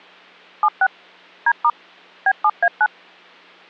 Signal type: DTMF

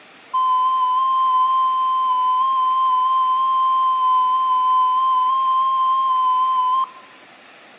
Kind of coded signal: FT8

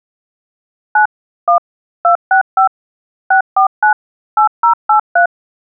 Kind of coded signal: DTMF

